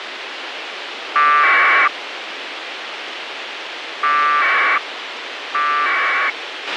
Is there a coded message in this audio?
Yes: packet radio (AX.25, as in APRS), 1200 baud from 1.2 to 6.3 s, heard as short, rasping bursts, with radio hiss and a squelch burst at the end.